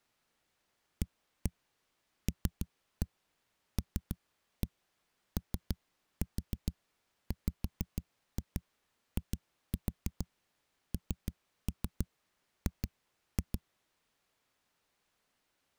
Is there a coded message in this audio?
Yes: tap code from 1.0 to 13.6 s, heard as knocks on a wall, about 6 knocks a second. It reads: ALLOWING